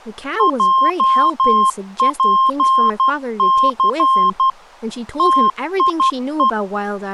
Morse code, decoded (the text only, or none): JPC TIE